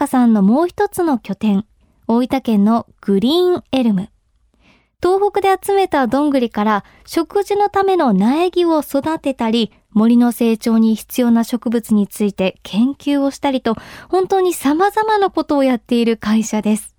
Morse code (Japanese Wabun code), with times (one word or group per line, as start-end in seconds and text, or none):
none